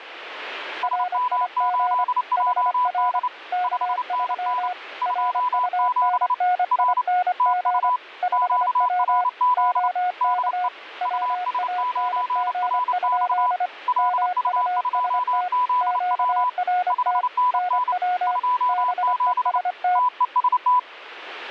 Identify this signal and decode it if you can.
Morse code, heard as two keyed tones, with radio static. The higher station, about 29 wpm, 990 Hz: SM8JD 5NN 27 R TU QRZ DE US9RX LU2ZW 5NN 27 TEST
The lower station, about 25 wpm, 720 Hz: RIG HR K3 RUNNING 5W OK WANG? MUST QRT NW BEST